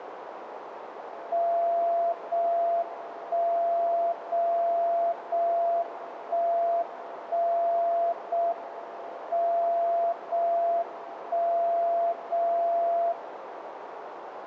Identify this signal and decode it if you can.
Radio time signal (JJY), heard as a tone whose level steps once a second, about 680 Hz, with radio static and a narrow filter. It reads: 0 1 0 0 1 1 0 M 0 1 0 0